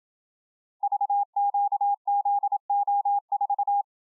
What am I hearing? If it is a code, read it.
Morse code, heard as a keyed tone, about 27 wpm, 810 Hz. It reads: VQZO4